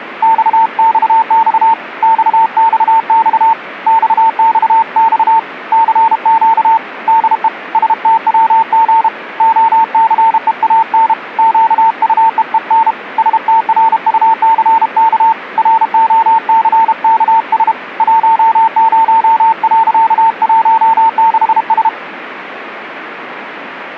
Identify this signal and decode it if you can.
Morse code, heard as a keyed tone, hand-sent with a paddle, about 32 wpm, 900 Hz, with radio static. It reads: XXX XXX XXX CQ DE STWG OCEAN QUEEN STRUCK ROCKS 10.16S